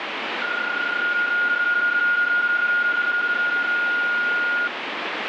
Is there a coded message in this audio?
Yes: PSK31 (31.25 baud) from 0.4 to 4.7 s, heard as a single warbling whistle, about 1430 Hz, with radio static.